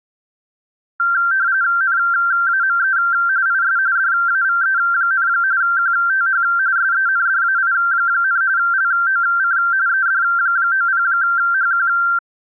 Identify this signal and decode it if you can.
RTTY (45.45 baud, 170 Hz shift), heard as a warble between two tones, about 1470 Hz centre. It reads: NAME IS DAVE, QTH SENDAI, LOC ED90HQ